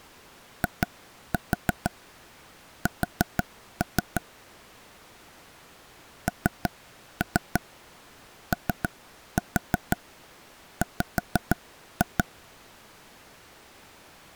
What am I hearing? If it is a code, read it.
Tap code, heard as taps on a table, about 6 knocks a second. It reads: IS NOW